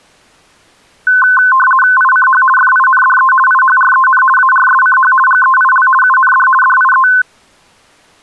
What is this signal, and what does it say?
RTTY (50 baud, 450 Hz shift), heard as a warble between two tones, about 1280 Hz centre. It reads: ICH FINDE IHREN ARSCH GEIL UND DIE